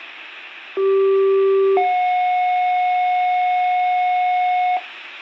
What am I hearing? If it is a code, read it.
Two-tone page, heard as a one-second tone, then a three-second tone, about 390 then 730 Hz.